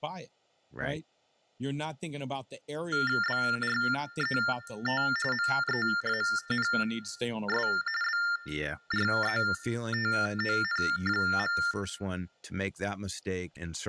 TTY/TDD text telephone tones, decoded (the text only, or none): BRET MEANS BRETON.